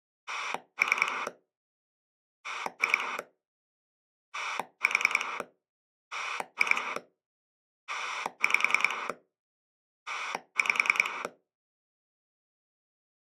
Pulse dialling, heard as a rotary dial, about 10 pulses a second. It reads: 3 2 4 2 5 5